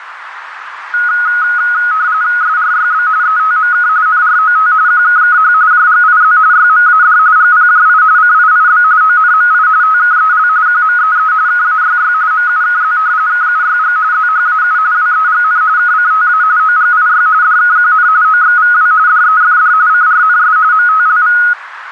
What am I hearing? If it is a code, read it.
RTTY (45.45 baud, 170 Hz shift), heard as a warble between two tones, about 1360 Hz centre, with radio static and a narrow filter. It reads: SRYB ETMK NROT QKKH JGIZ YMAD GPJI CIIB ONMI TKEL QMEE KAYY MUKZ KUYG ZHAU WEGN KCTA OGIY DKQN OXVW DEFD CRNS MTLV